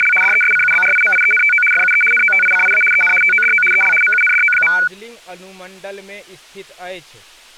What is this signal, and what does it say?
RTTY (75 baud, 850 Hz shift), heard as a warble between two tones, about 1900 Hz centre, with speech in Maithili. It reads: … DESCUBRIMIENTO FUE NOTICIA EN TODO EL MUNDO.